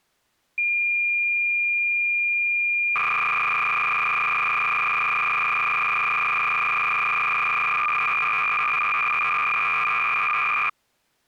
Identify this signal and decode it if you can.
Cassette data (Kansas City type), 300 baud, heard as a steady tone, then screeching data.